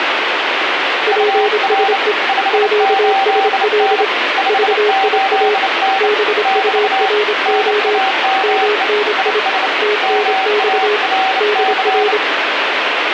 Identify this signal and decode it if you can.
Morse code, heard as two keyed tones, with heavy radio static. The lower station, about 26 wpm, 420 Hz: PSE QSL VIA BURO MNI TNX DR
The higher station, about 29 wpm, 770 Hz: UR 58N 58N <BT> NAME IS MARC